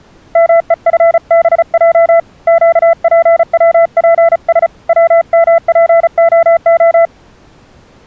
Morse code, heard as a keyed tone, hand-sent with a paddle, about 35 wpm, 670 Hz. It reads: MEFBJ QPWPS WMPOO